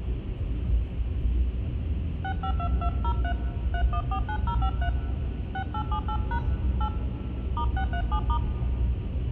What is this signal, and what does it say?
DTMF, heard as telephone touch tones, dialled by hand, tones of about 80 ms, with room echo and the noise inside a car. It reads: 652203 3149053 6878# 8 *637*